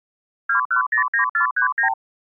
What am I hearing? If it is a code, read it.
Multi-frequency trunk signalling (R2, with the far end's replies), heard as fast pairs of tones, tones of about 110 ms. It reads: 2109439